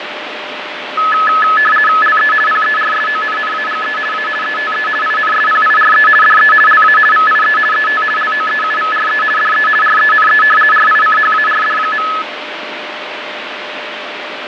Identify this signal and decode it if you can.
RTTY (50 baud, 450 Hz shift), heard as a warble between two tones, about 1500 Hz centre, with radio static and fading. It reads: LE PERSONNAGE A ETE INSPIRE DE LA VIE ET LOEUVRE DE RENE RICHARD.